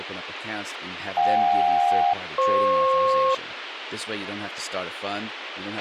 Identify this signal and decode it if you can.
Aircraft SELCAL, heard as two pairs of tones, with radio hiss, a squelch burst at the end and speech in English. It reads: JK-FP